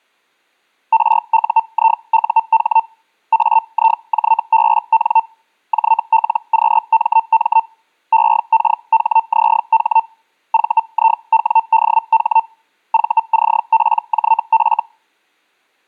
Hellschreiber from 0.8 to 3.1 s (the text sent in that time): RUIUH